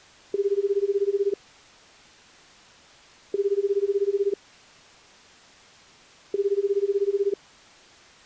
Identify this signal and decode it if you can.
Telephone call progress tone (Japanese plan), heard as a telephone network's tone, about 380, 400, 420 Hz, 1 s on and 2 s off. Ringback tone.